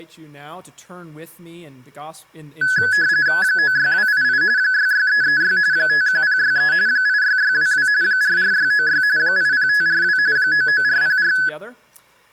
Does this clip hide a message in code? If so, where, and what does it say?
Yes: RTTY (45.45 baud, 170 Hz shift) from 2.6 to 11.5 s, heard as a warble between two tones, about 1600 Hz centre. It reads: 96288 66336 51063 86622 44696 80542 99404